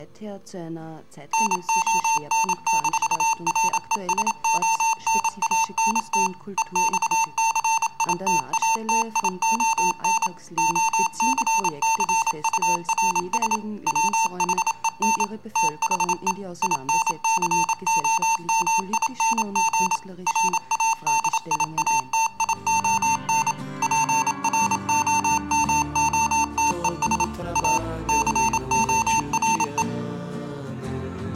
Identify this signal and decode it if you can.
Morse code, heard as electronic beeps, machine-sent, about 27 wpm, 900 Hz. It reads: NON-RESONANT EXCITATION OCCURS WHEN THE INCOMING RADIATION PROMOTES A CORE